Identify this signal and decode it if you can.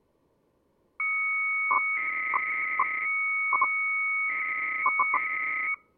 300-baud modem data (Bell 103 tones), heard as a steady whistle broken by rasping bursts, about 300 baud, 200 Hz shift.